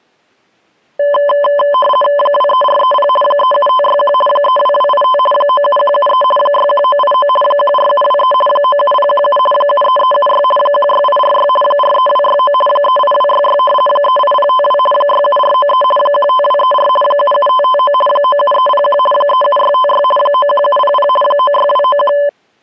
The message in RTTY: 23430 37561 32285 97173 61989 14723 97017 73376 16846 43269 38266 38052 67493 15234 77559 97301 37656 91700 96291

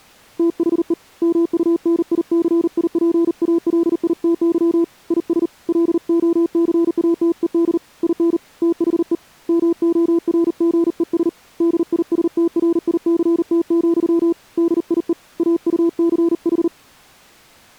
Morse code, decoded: THE MUNICIPALITY IS LOCATED IN THE MORGES DISTRICT, DIE AUCH

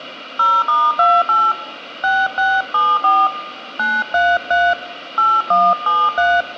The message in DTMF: 0*28 6674 933 8173

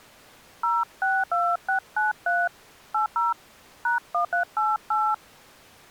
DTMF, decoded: 062693 80 #1388

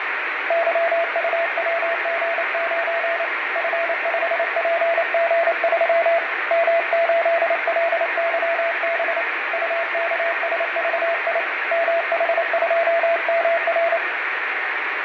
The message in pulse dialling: none

